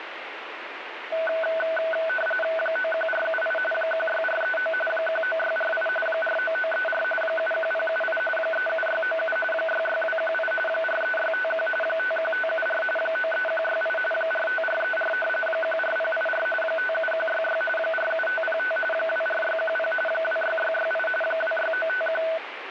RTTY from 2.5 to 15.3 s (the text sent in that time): 91478 16439 19648 49934 71078 37697 66218 43651 51574 93168 45434